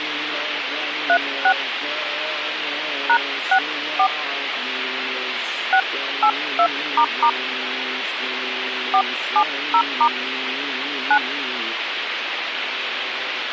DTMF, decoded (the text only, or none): 36 #64 682** 470* 9